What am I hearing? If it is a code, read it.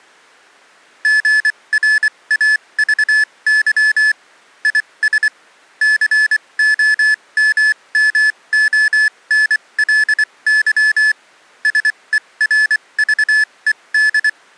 Morse code, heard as electronic beeps, machine-sent, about 24 wpm, spaced as for 20 wpm, 1750 Hz. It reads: GRAVY IS COMMONLY SERVED